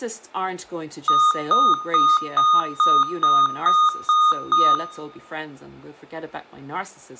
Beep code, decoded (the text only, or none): 9 short